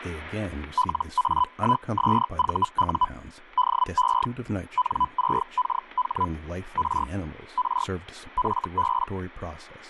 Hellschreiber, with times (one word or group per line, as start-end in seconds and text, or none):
0.8-3.1 LA1SVU
3.6-4.3 DE
4.8-6.3 N6KH
6.8-7.1 R
7.6-7.9 R
8.4-9.1 FB